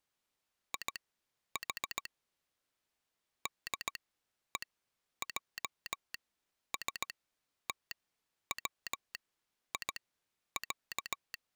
Morse code (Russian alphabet), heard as a telegraph sounder, machine-sent, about 17 wpm, spaced as for 10 wpm. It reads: ИХ ДЕЙСТВИЯ